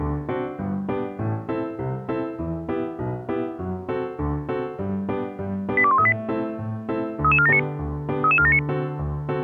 Five-tone selective call (ZVEI), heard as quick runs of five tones, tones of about 70 ms. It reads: 82138 33479 33479